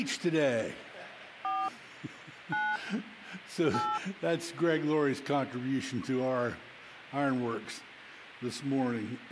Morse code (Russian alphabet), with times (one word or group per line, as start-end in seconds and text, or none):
none